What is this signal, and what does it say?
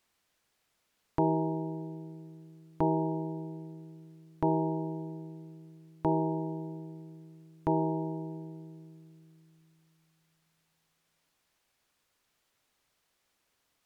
Clock strike, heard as a bell. 5. Five o'clock.